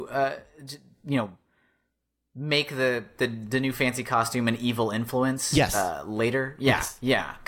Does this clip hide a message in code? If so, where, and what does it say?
No, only speech in English.